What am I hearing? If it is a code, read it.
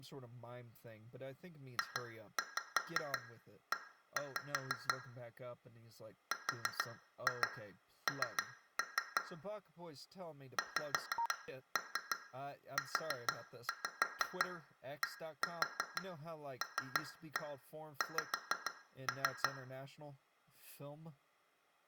Tap code, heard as taps on glass, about 6 knocks a second, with room echo and speech in English. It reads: JE RN XUDLX